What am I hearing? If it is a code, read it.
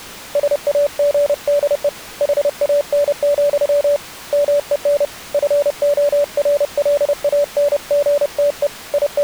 Morse code, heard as a keyed tone, hand-sent with a paddle, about 30 wpm, 580 Hz. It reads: SAGDE HAN, MEN FORLANGTE …